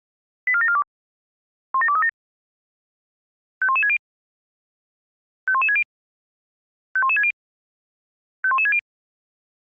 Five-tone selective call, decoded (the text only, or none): 84742 17237 51160 51160 51160 51160